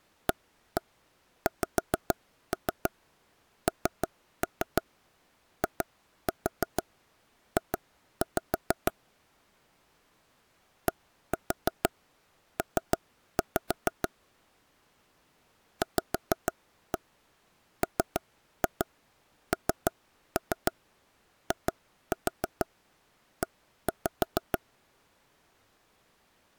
Tap code, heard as taps on a table, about 6 knocks a second. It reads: AXNIJ DP VMNIE